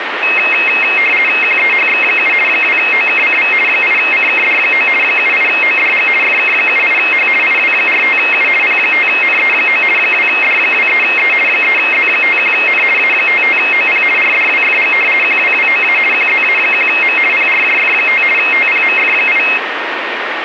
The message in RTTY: QEHX7 2OKCV 8CKD9 78ODG FK78H IW45U P5NE9 2D23E 3Z51N A55OP RDWFG QWWOA QZA1M PRJF5 TPMF8

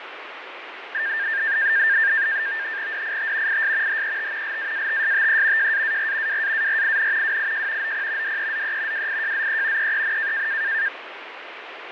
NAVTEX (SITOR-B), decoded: DIT IS HET LAATSTE JAAR WAARIN WIJ OP DEZE WIJZE EEN

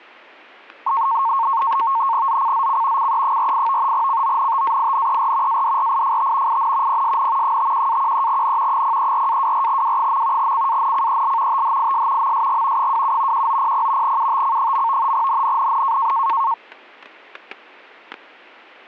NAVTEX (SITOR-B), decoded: ZCZC CE48 CONTAINER ADRIFT IN PSN 51-13N 034-24W. CANCEL THIS MSG 27 1900 UTC. NNNN

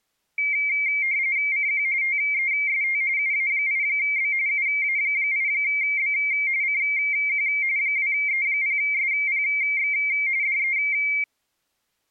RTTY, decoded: CQ TEST UA8B UA8B CQ 2E0SPX DE

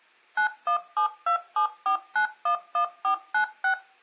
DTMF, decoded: 917274911496

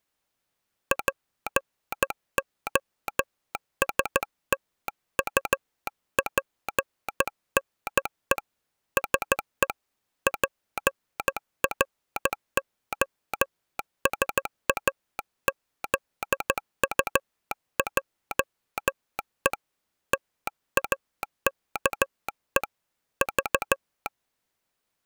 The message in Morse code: POSTUPNE SE PROSAZUJE TAKE V

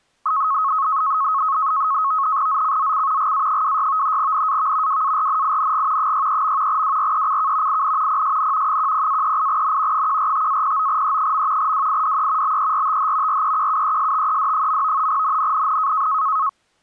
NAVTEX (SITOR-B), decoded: ZCZC GA26 NAV WARNING 63. WRECK IN PSN 10-38N 145-09E. WIDE BERTH REQUESTED. NNNN

